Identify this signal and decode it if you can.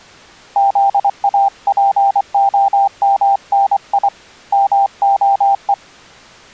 Morse code (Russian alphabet), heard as a keyed tone, hand-sent with a paddle, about 24 wpm, 790 Hz. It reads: ЗАПОМНИ МОЕ